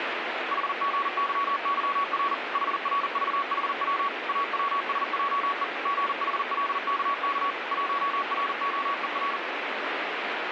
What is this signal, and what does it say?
Morse code, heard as a keyed tone, machine-sent, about 40 wpm, 1120 Hz, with radio static. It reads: HGYYR HRVHW AWSJE GHLKK 1ROER